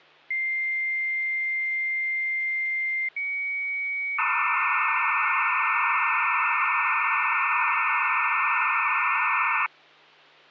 Dial-up modem handshake (low-speed, two carriers), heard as two whistles, then hiss, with hum.